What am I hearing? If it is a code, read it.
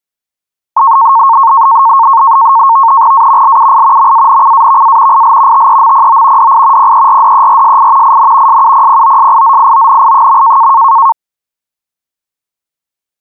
NAVTEX (SITOR-B), 100 baud, 170 Hz shift, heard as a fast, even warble, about 1000 Hz centre. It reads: A LUI MANCAVA IL TEMPO DI PERDERSI IN SUPPOSIZIONI.